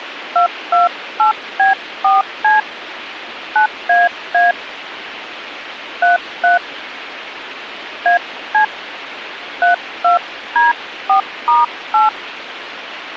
DTMF, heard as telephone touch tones, dialled by hand, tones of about 140 ms, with radio hiss. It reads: 228B4C 9AA 33 AC 32D4*8